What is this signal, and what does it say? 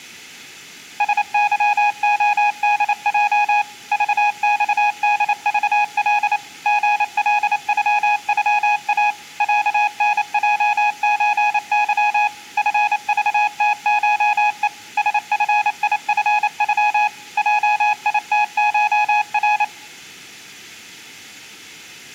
Morse code (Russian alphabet), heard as a keyed tone, machine-sent, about 28 wpm, 830 Hz. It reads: СЫОДЙ ЖЬДЖЛ ГЛЮЮА ЯНЙЧЫ ФЖТШЕ СФИФЮ ЙИТШР